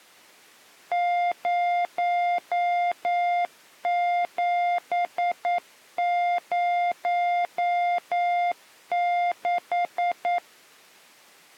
Morse code, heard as a keyed tone, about 9 wpm, 700 Hz. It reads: 0706